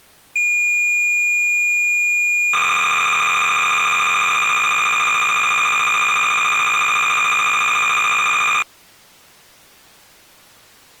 Cassette data (Kansas City type), 300 baud, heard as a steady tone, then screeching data.